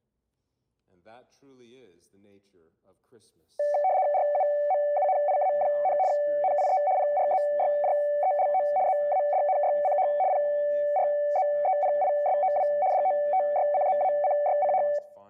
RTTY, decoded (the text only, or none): RUMUNIA, NIE PRZYJELO ZADNYCH PRZEPISOW DOTYCZACYCH